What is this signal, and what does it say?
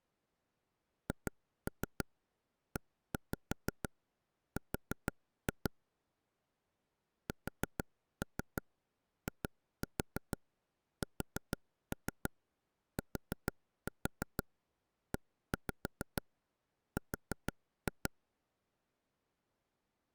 Tap code, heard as taps on a table, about 6 knocks a second. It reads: HER SISTER